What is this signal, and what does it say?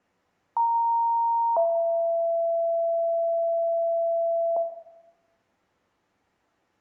Two-tone page, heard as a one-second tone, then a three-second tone, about 930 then 670 Hz, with room echo.